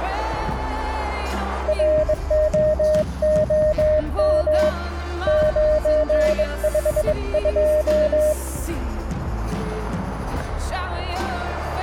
Morse code, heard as a keyed tone, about 22 wpm, 610 Hz. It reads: ROOM 952